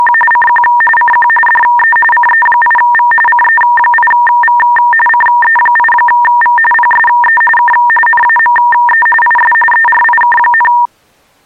RTTY (45.45 baud, 850 Hz shift), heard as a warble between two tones, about 1390 Hz centre. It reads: … CQ CQ DE CE8V CE8V CE8V PSE K NAME IS ERIK,